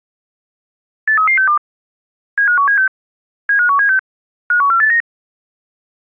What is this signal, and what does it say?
Five-tone selective call (CCIR), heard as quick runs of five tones, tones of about 100 ms. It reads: 83362 75176 75176 51489